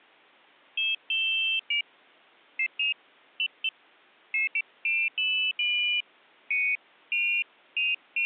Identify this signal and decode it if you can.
Pairs of high tones at irregular times. There is no code.